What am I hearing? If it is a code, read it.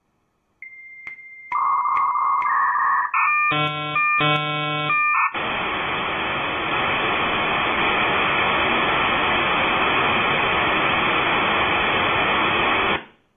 Dial-up modem handshake (V.34 or later), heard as a whistle, warbles, then hiss, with room echo.